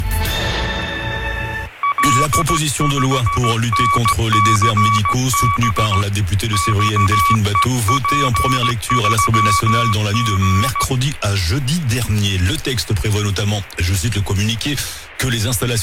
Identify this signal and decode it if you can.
Morse code, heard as a keyed tone, hand-sent with a straight key, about 16 wpm, 1140 Hz, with fading. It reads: L5NCB XEP3G